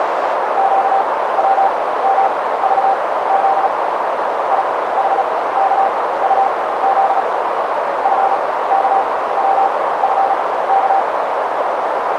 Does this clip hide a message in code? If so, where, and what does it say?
Yes: Morse code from 0.5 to 11.1 s, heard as a keyed tone, machine-sent, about 36 wpm, spaced as for 18 wpm, 780 Hz, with heavy radio static and a narrow filter. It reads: QWMVZ IHKUZ FKWFK